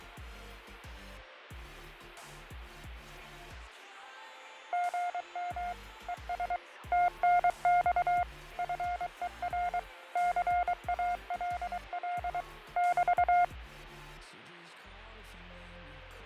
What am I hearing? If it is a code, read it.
Morse code, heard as a keyed tone, machine-sent, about 23 wpm, 710 Hz, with radio static and fading. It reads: GM ES TNX FER CALL <BT>